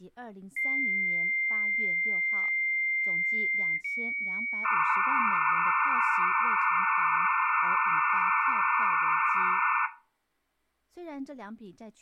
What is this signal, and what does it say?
Dial-up modem handshake (low-speed, two carriers), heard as two whistles, then hiss, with speech in Chinese.